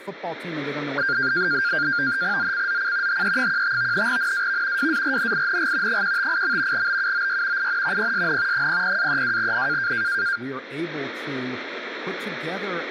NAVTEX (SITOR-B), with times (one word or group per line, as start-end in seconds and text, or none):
2.4-3.2 ZCZC
3.1-4.1 HE15
4.1-4.9 NAV
4.8-6.0 WARNING
5.9-6.9 158.
6.7-7.7 BUOY
7.6-8.1 IN
8.0-8.7 PSN
8.5-9.9 00-32N